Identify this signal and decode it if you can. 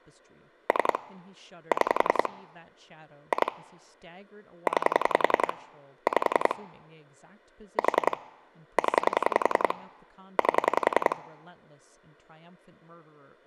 Pulse dialling, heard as clicks on a phone line, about 10 pulses a second, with speech in English. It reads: 3 6 2 9 5 4 0 8